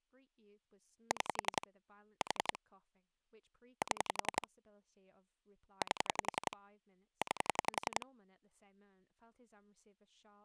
Pulse dialling, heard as clicks on a phone line, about 11 pulses a second, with speech in English. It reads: 6 4 7 8 9